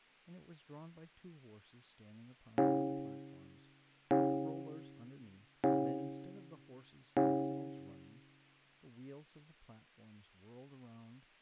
Clock strike, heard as a bell, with speech in English. 4. Four o'clock.